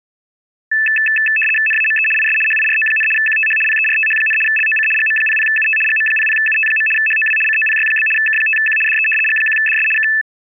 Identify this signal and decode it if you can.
RTTY (75 baud, 850 Hz shift), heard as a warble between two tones, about 2200 Hz centre. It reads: NAME IS HIRO, QTH PERTH, LOC GM00UT GM00UT. HOW COPY? K5Q DE G1DS K